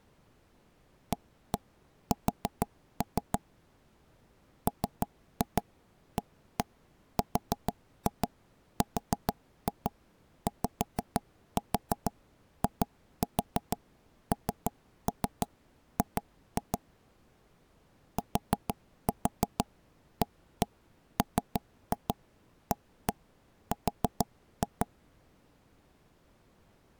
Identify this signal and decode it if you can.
Tap code, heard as knocks on wood, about 6 knocks a second. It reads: AS MARRYING TAMAR